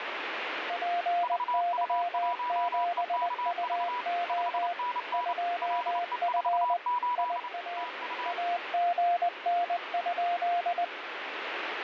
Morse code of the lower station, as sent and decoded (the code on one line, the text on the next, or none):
.--. -.-- --... ..- --- / ..--- ..-. / .. .- / .- --. -. ..--..
PY7UO 2F IA AGN?